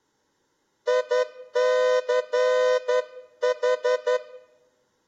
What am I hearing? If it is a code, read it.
Morse code, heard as a horn, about 11 wpm. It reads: ICH